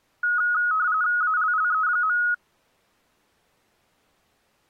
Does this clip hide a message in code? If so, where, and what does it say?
Yes: RTTY (45.45 baud, 170 Hz shift) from 0.2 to 2.3 s, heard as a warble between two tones, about 1360 Hz centre. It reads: ALLE.